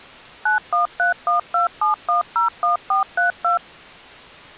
DTMF, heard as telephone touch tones, dialled by machine, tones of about 130 ms. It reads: 913127101432